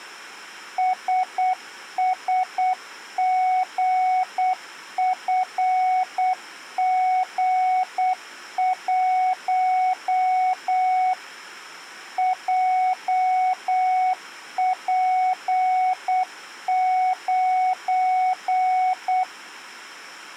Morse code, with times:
0.8-11.1 SSGFG1
12.2-19.2 JP9

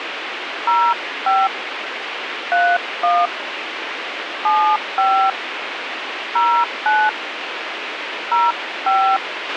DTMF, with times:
0.7-1.5 05
2.5-3.3 31
4.5-5.3 75
6.4-7.1 09
8.3-9.2 05

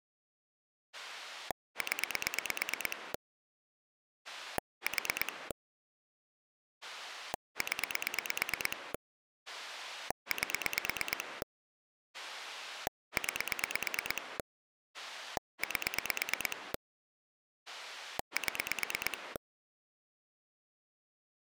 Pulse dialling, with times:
0.9-3.1 0
4.2-5.5 4
6.8-8.9 0
9.5-11.4 8
12.1-14.4 9
14.9-16.7 8
17.7-19.4 7

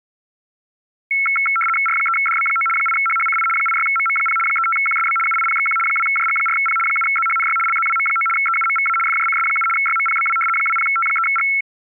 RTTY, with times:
1.9-2.7 R3DB9
2.8-3.5 8HHCI
3.6-4.4 86MM0
4.5-5.2 35QSB
5.3-5.8 UIPXQ
5.9-6.8 2JG4P
6.9-7.6 7ZHNY
7.7-8.3 LZWM9
8.4-9.0 EUMVA
9.1-9.7 FJCS7
9.8-10.4 YMPBW
10.6-11.5 20T3G

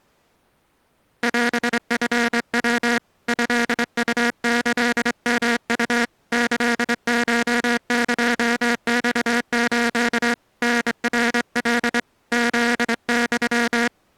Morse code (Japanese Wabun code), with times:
1.2-3.0 オチヤ
3.3-6.0 トウキヨウ
6.3-10.3 キコエマス
10.6-12.0 タナカ
12.3-13.9 フユ

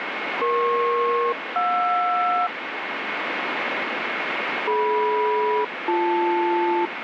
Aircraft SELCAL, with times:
0.4-2.5 EP-JR
4.7-6.9 DM-BL

